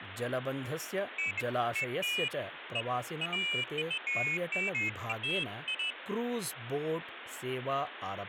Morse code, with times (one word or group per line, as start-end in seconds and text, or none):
none